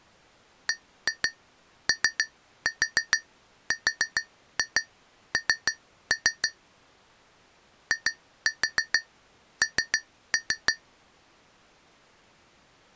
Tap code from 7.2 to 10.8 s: IN

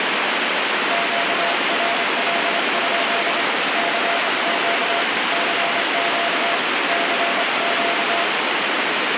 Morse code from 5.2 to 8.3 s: CQ CQ

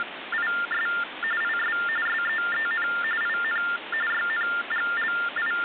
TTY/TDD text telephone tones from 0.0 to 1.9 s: … IS

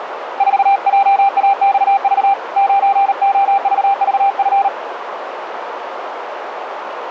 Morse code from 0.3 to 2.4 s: 4JAXV

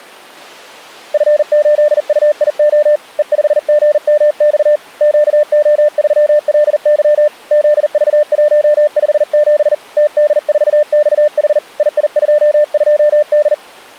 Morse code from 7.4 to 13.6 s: ZV157 TD4XH II22D

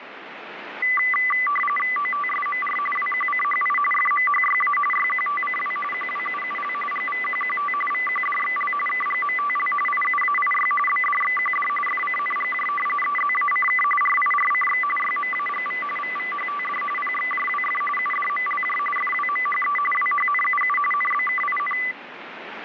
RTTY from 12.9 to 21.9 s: EZACK RIRCX YMAGV VVHTD PXJWF UDMLJ FWMHE WHNUU NBKIN

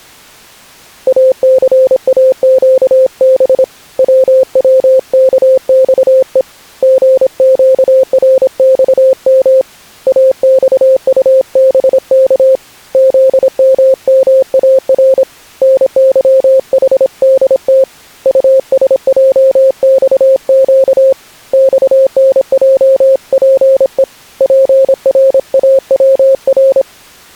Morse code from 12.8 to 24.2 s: ZMMAR NYHDT USJXQ XNJPE

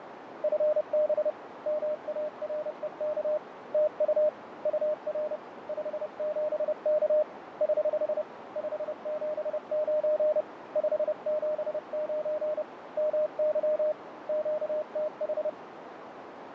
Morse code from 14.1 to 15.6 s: QTH

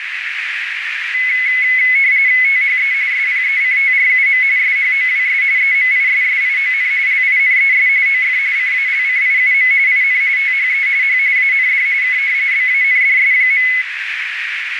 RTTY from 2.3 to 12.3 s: THE SPECTRUM SHOWS EMISSION LINES OF CALCIUM IN THE H AND K

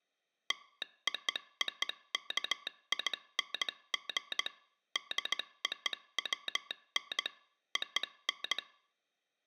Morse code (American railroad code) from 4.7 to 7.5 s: DOWN

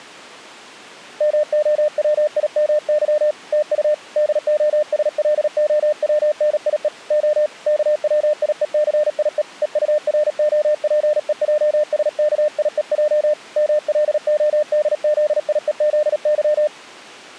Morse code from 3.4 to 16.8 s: TU DOSLOWNIE O KWIECIE EUROPEJSKIEJ MLODZIEZY

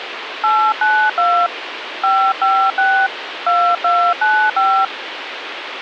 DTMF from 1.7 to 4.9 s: 556 2295

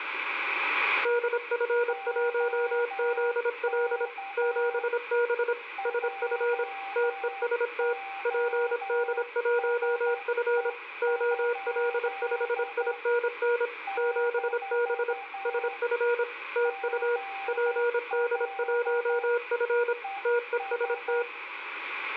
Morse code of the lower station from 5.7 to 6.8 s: SF

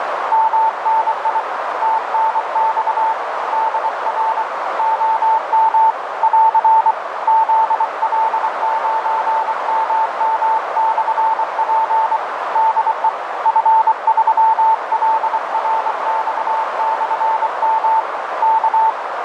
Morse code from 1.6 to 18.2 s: TNX DR OM <AR> ZL9MM/P DE F3LRX/M

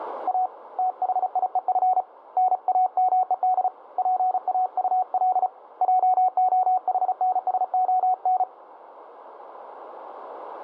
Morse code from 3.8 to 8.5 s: PAUL JOHNSON

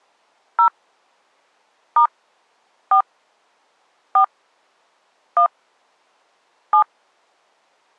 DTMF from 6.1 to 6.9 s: 7

